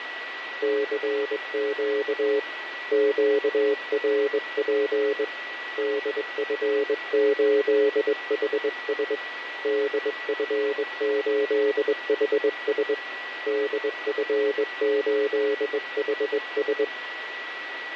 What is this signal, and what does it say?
Morse code, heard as a keyed tone, hand-sent with a straight key, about 21 wpm, 420 Hz, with radio static and a steady whistle near 1940 Hz. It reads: CQ QRP DF8HS DF8HS DF8HS